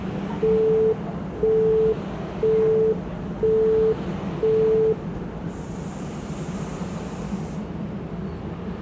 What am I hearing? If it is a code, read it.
Telephone call progress tone (single-tone plan, as in Europe, Japan and elsewhere), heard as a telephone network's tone, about 440 Hz, 0.5 s on and 0.5 s off, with the noise of a subway station. Busy tone.